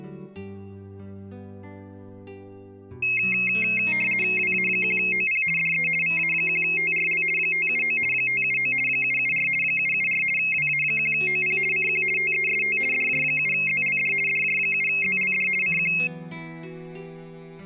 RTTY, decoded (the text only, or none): WA1OP DE VA1TRL 579 579 774 774 WA1OP CQ TEST DJ7ZLD DJ7ZLD CQ